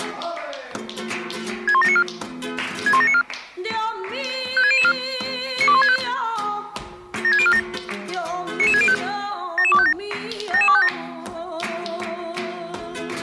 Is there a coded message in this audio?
Yes: five-tone selective call (ZVEI) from 1.7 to 10.9 s, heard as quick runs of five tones, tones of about 70 ms. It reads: 61794 61794 56004 92165 76047 99605 77257 77257